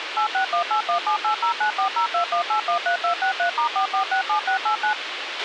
DTMF, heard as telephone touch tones, dialled by machine, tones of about 100 ms, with radio hiss and a squelch burst at the end. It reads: 8618178094021813263*4467689